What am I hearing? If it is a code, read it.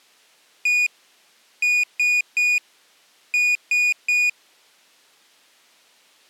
Beep code, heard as a piezo beeper, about 2450 Hz. 1-3-3. In Phoenix BIOS tables: chip or data line failure in the first 64 KB of memory.